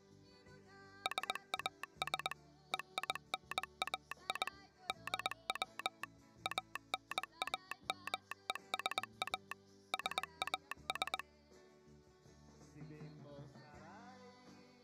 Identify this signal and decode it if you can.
Morse code (Greek alphabet), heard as a telegraph sounder, machine-sent, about 20 wpm. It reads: ΣΑΣ ΕΙΝΑΙ ΔΩ ΑΝΑΜΕΣΑ ΣΑΣ